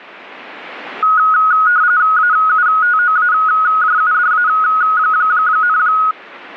RTTY (45.45 baud, 170 Hz shift), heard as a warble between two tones, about 1360 Hz centre. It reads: AUTOAJUDA,